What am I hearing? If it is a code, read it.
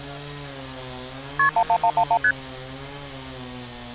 Multi-frequency trunk signalling (R1, as on North American trunks), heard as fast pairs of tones, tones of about 70 ms, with street noise. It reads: KP 11111 ST